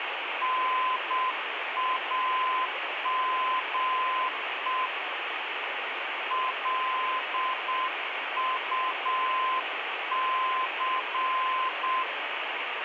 Morse code, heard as a keyed tone, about 7 wpm, 1030 Hz, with radio static. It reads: NAME LUC